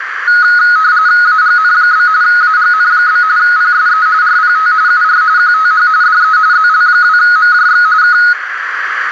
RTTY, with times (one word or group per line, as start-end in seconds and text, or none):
1.2-2.1 AGN?
2.2-3.2 AGN?
3.4-4.1 PSE
4.2-4.7 RPT
4.9-5.2 UR
5.4-5.9 QTH
6.0-6.4 DE
6.5-7.9 ZL2MJX
8.0-8.2 K